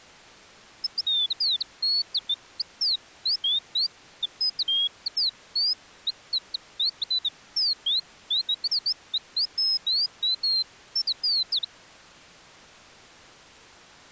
Bird-like chirps. There is no code.